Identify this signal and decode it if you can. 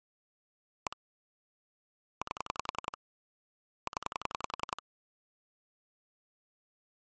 Pulse dialling, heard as clicks on a phone line, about 10 pulses a second. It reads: 1 8 0